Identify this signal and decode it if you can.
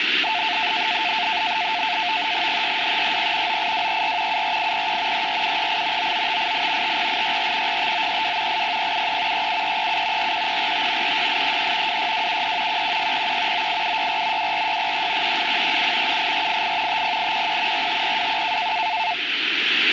NAVTEX (SITOR-B), 100 baud, 170 Hz shift, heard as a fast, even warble, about 800 Hz centre, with radio static. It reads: 62330 98234 74801 34738 99588 50864 65932 80073 37337 41045 36833 26273 11601 98764 24603 37137 78488 50811 45021